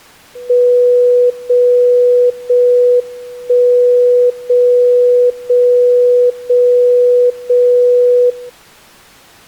Radio time signal (JJY), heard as a tone whose level steps once a second, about 490 Hz. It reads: 0 0 1 0 0 0 0 0